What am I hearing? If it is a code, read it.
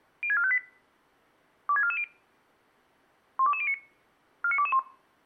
Five-tone selective call (ZVEI), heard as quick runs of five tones, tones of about 70 ms. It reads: 06458 26440 12209 49221